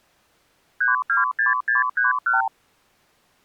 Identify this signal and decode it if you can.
Multi-frequency trunk signalling (R2, with the far end's replies), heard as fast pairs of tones, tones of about 150 ms. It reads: 326631